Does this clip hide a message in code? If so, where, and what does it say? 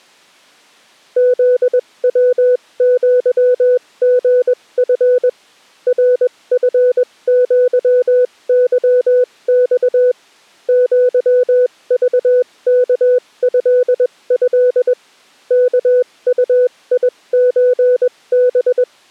Yes: Morse code (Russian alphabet) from 1.1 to 18.9 s, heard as a keyed tone, machine-sent, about 21 wpm, spaced as for 18 wpm, 500 Hz. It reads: ЗВЪГФ РФЪЫЬ ЪЖКЭЭ КУИЧБ